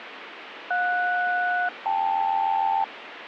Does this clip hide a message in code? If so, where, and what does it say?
Yes: aircraft SELCAL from 0.7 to 2.8 s, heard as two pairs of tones, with radio static. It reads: JS-KL